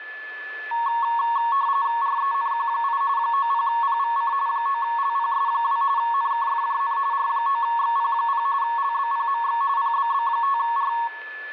RTTY (45.45 baud, 170 Hz shift), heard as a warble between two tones, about 1020 Hz centre, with a steady whistle near 1730 Hz and room echo. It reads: RENQ8 90PVC 9LPS2 NKFJN R9XP0 LBPMX PBB5R